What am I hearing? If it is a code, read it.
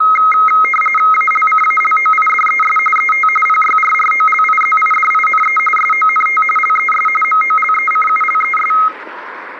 RTTY (45.45 baud, 850 Hz shift), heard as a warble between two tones, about 1700 Hz centre, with static crashes and street noise. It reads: ALCALOIDES ET PYRROLIZIDINE SONT LES MOLECULES